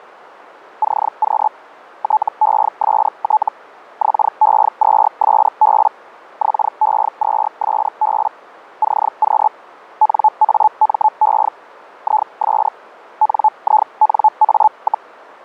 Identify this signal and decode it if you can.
Hellschreiber (Feld-Hell, 122.5 baud), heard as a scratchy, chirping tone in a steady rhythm, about 860 Hz. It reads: CQ TEST XE2SB XE2SB CQ NAME IS NINA,